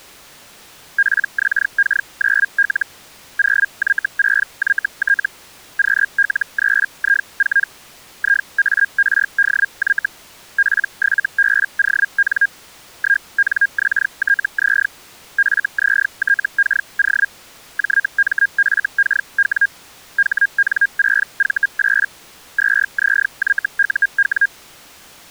Hellschreiber (Feld-Hell, 122.5 baud), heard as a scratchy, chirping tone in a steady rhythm, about 1600 Hz. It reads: PXK9L 0Y6YT QL3I4 IARDY P7BON 1NXTZ FZTKO JMFKW HN6V8 2ZYUW